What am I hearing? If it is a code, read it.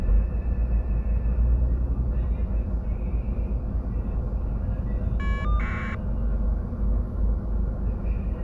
Caller ID data burst, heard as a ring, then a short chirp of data, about 1200 baud, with the noise inside a bus.